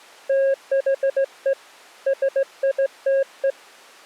Morse code, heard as a keyed tone, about 17 wpm, 540 Hz. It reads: THE SITE